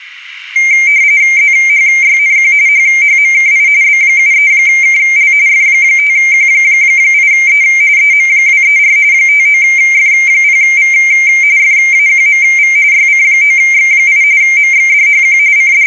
RTTY (45.45 baud, 170 Hz shift), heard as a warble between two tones, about 2200 Hz centre, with static crashes. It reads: ZHYNQ HHMKI B73KL F5Q8E EM234 59F0V FAQMV YC9X8 MXDHQ …